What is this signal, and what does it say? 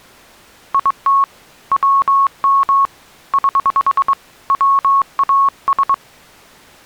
Morse code, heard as a keyed tone, hand-sent with a straight key, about 22 wpm, 1100 Hz. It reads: IT WM <HH> WAS